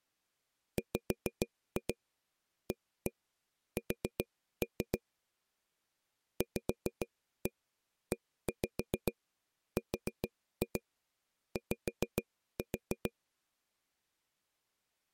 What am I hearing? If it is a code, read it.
Tap code, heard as taps on a table, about 6 knocks a second. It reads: WAS VERY